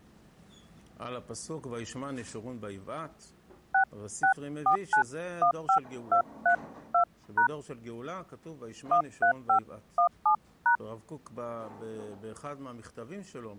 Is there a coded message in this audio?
Yes: DTMF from 3.7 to 10.8 s, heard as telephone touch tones, dialled by hand, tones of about 100 ms. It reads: 664915232# 13517#